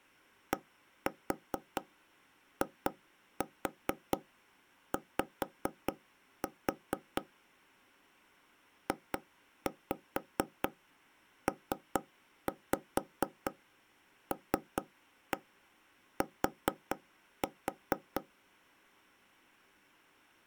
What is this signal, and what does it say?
Tap code, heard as taps on a table, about 4 knocks a second. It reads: DIY JPLT